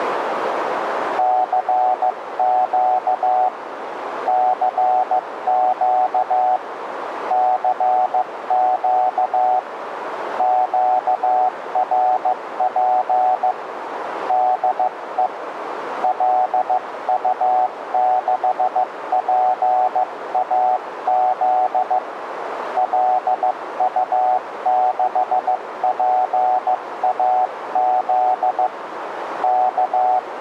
Morse code, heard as a keyed tone, hand-sent with a paddle, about 15 wpm, 740 Hz, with radio static and a narrow filter. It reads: CQ CQ CQ QRP DE LU6PAZ LU6PAZ K